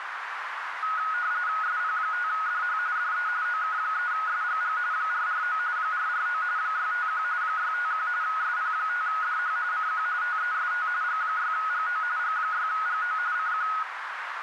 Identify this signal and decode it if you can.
RTTY (45.45 baud, 170 Hz shift), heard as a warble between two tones, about 1360 Hz centre, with radio static and a narrow filter. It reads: SP5DH DE OK3SGG 449 449 651 651 SP5DH CQ TEST G6GO G6GO CQ